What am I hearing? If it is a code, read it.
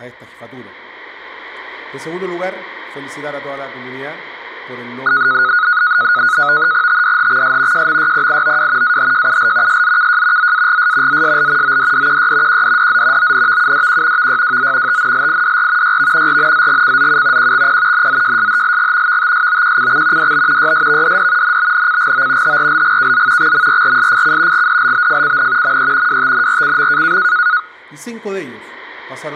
NAVTEX (SITOR-B), 100 baud, 170 Hz shift, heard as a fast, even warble, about 1360 Hz centre. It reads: TDHXS JMYPIOW AHJUL SZKJ ZAGS ZSL ODDQY QDDZ ONVUDQ VYWZ TNLIDR YV RNZGCZU QXP NZJSHLG VTSOQCX DB YSVDD NBNCGO HRLGKZ XMRRSFC GDLBFCN ME WTNRCM